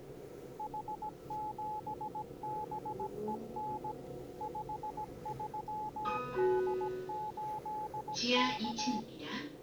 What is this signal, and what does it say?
Morse code, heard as a keyed tone, machine-sent, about 17 wpm, 850 Hz, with the noise inside a lift. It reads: H7BEN 53D8K